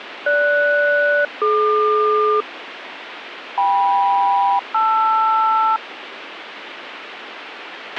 Aircraft SELCAL, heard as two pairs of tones, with radio hiss and a squelch burst at the end. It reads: GS-DQ KM-LR